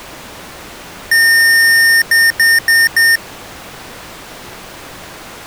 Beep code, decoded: 1 long, 4 short

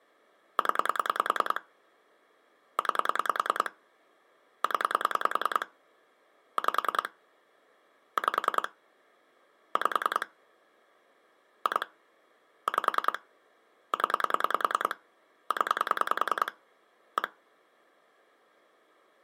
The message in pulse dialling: 0 9 0 5 5 5 2 5 0 0 1

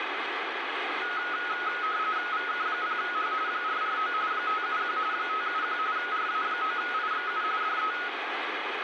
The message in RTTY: VK0H 449 571 571 RA9IXU DE

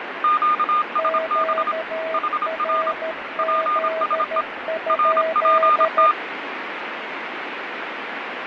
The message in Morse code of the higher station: QSB HR PSE RPT

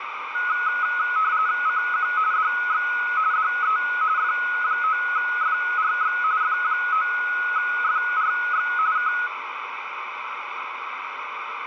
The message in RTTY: CQ DX DE F9FRX F9FRX K

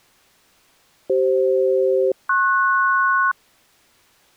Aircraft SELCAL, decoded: CF-PS

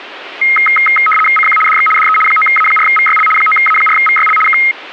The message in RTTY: CQ DX DE 9A4VYL 9A4VYL K

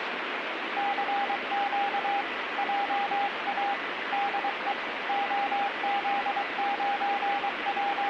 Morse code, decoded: CQ JA DE …

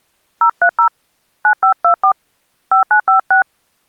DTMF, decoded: 030 9524 5956

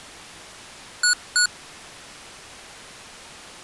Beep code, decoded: 2 short

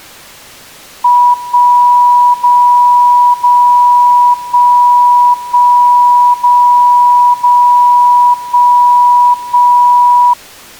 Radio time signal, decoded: 1 0 0 1 1 0 0 1 1

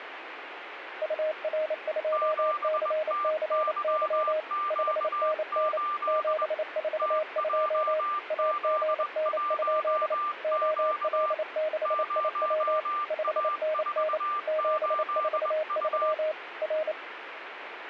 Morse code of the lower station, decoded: UR2CCY 5NN 742 AGN? OL6IW 5NN 743 R

